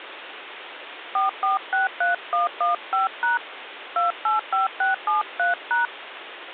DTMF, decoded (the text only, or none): 4463115# 285673#